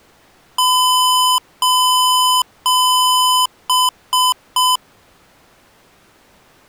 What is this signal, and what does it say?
Beep code, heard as beeps from a small speaker, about 1010 Hz. 3 long, 3 short.